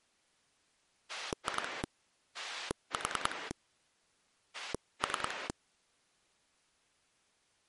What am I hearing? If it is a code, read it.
Pulse dialling, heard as a rotary dial, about 10 pulses a second. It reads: 2 4 3